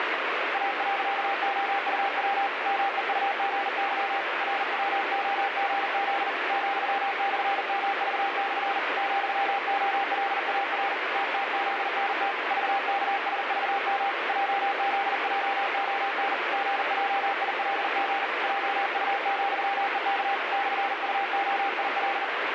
Morse code, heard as a keyed tone, hand-sent with a paddle, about 40 wpm, 790 Hz, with heavy radio static. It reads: A.OUW MEUGY RWOGZ ,/MV/ ,OLAR TTZNT VKSVM JZJON GJILG JU,EK /UOIL